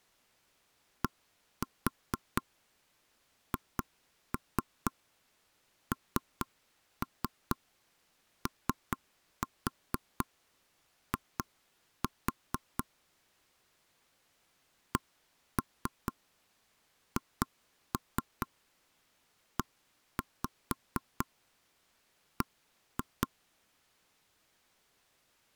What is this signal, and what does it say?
Tap code, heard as knocks on wood, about 4 knocks a second. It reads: DHNOI CHEB